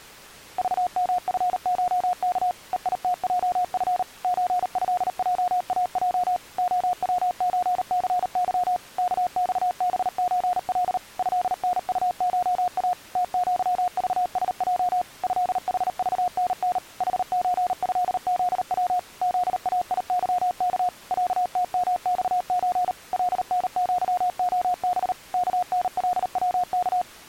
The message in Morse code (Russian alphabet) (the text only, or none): ЖМФШК ЕИТЙФ ЧЭЙАЙ ОВЧЦЫ КЬБЧЛ ЭНУША ТЪЖСЙ ЭХЖНН ХЧЭЗВ ЗАИЫК ЯТМЬЧ ЛНЪОБ КНЛВК